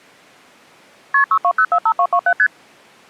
Multi-frequency trunk signalling (R1, as on North American trunks), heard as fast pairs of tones, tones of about 70 ms. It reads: KP 62045227 ST